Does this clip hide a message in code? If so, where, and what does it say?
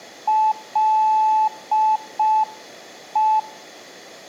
Yes: Morse code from 0.2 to 3.5 s, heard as a keyed tone, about 5 wpm, 870 Hz. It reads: LE